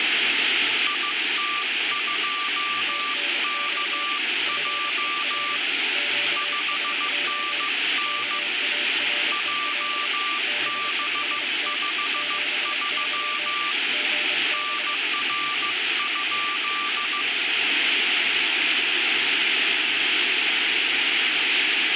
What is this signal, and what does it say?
Morse code, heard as two keyed tones, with radio static and speech in English. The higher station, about 15 wpm, 1180 Hz: IT2KJ 5NN JB53 NR?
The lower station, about 25 wpm, 590 Hz: TNX FER QSO KAREL BEST 73 GB